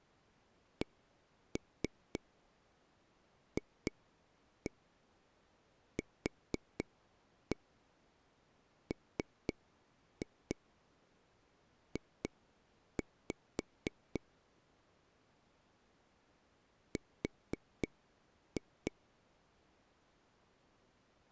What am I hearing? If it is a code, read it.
Tap code, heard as taps on a table, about 4 knocks a second. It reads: CFQMJ R